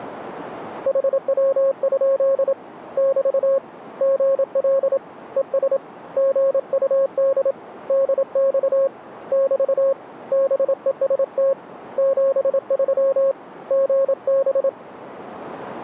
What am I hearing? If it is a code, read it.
Morse code, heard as a keyed tone, hand-sent with a paddle, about 27 wpm, 540 Hz. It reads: HW? <BT> GL ES GUD DX <BT> BEST 73 GB